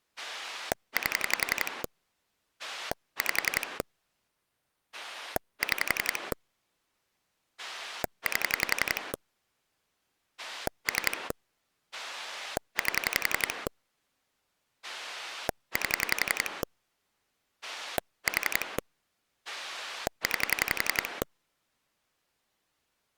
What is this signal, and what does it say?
Pulse dialling, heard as a rotary dial, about 11 pulses a second. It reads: 8 5 6 8 3 8 8 4 9